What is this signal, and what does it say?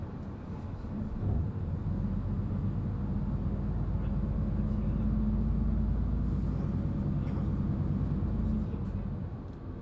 The noise inside a bus. There is no code.